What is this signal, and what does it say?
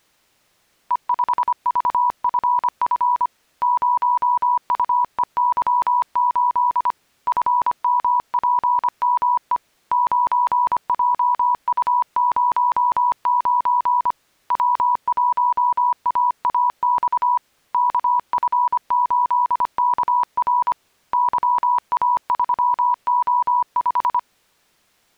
Morse code, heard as a keyed tone, hand-sent with a paddle, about 25 wpm, 980 Hz. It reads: E5VFF 0UEY8 FMPME 9JU09 W1AAX KF8KR YA3O5